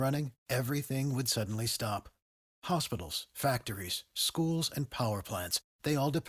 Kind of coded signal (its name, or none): none